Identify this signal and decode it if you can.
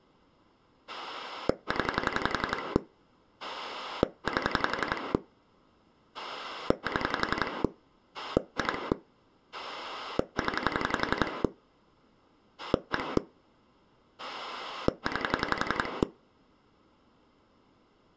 Pulse dialling, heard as a rotary dial, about 11 pulses a second. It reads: 0 8 7 2 0 1 9